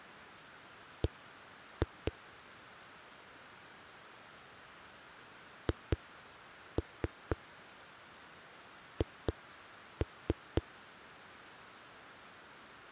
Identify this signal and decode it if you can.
Tap code, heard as knocks on a wall, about 4 knocks a second. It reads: B HH